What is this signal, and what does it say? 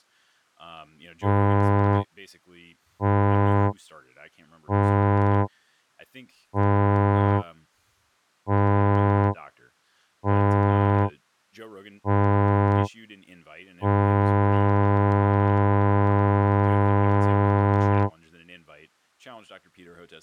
Ship horn signal, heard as a ship's horn, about 100 Hz, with speech in English. 7 short, 1 long. At sea: general emergency alarm.